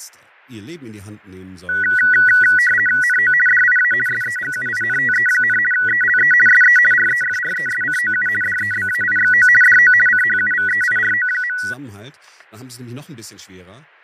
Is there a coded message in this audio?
Yes: RTTY (50 baud, 450 Hz shift) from 1.7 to 11.7 s, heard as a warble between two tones, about 1700 Hz centre, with fading and speech in German. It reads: NO DIA SEGUINTE, ELE SE REFRESCOU DEBAIXO DO CHUVEIRO.